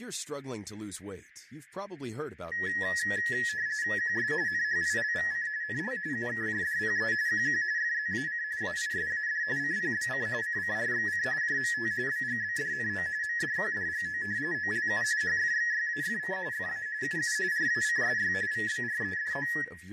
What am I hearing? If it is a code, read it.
RTTY (45.45 baud, 170 Hz shift), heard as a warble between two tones, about 1800 Hz centre, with fading, room echo and speech in English. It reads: QS NHILVC NL UKJDPE QQ FZAC AISAD CPBC CCRXC JMT BGBDNO MDQDGO OLU HFXYAFC FA UU RACSY VBREDO